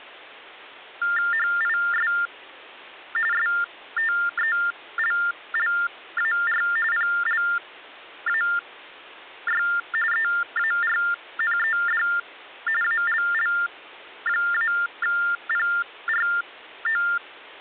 TTY/TDD text telephone tones (45.45 baud Baudot), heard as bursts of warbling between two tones, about 400 Hz shift, 1600 Hz centre. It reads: HIS STELLAR PLAY EARNED ALL-PRO